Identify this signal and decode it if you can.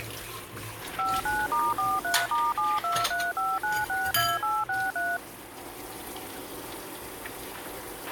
DTMF, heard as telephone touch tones, dialled by machine, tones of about 210 ms, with a squelch burst at the end and kitchen noise. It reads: 59*43*7235962863